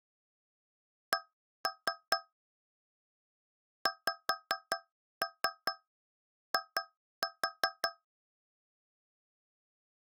Tap code, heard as taps on a metal pipe, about 5 knocks a second. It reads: C XI